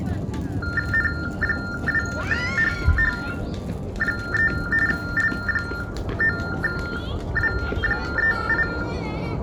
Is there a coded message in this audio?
Yes: TTY/TDD text telephone tones (45.45 baud Baudot) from 0.6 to 8.8 s, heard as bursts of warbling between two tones, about 400 Hz shift, 1600 Hz centre, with room echo and the noise of a residential street. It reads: N2HH3 L9W38